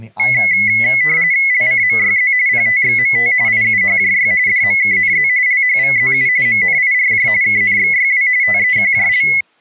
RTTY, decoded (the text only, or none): LCMYZ PTXMT IUHJY DMKNZ LHVZU MNIRJ KNXYW TEQJL